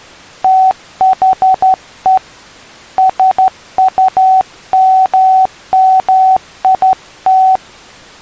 Morse code, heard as a keyed tone, hand-sent with a straight key, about 12 wpm, 760 Hz. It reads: THE SUMMIT